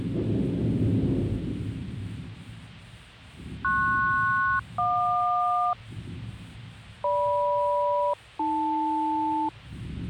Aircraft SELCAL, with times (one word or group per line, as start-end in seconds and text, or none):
3.6-5.7 PS-JQ
7.0-9.5 GM-AL